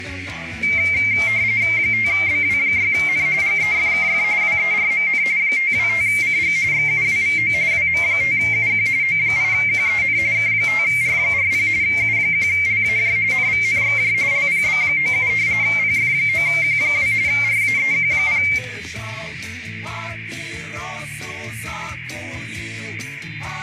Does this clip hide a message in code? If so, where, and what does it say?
Yes: RTTY (45.45 baud, 170 Hz shift) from 0.6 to 18.6 s, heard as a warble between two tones, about 2200 Hz centre, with radio static and a narrow filter. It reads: 5BW6N GEFKF WERMN 525CG XUWVO WM5UQ O8QEN K5R40 U1LAJ NVNXJ LPB97 PF9Q2 RAEQ0